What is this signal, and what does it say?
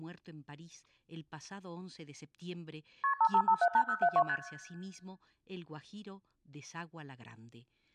Multi-frequency trunk signalling (R1, as on North American trunks), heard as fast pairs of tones, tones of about 70 ms, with speech in Spanish. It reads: KP 55578072 ST